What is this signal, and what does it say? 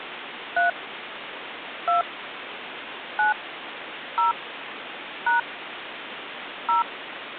DTMF, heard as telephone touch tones, dialled by hand, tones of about 140 ms, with phone line noise. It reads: 3 2 9 0 # 0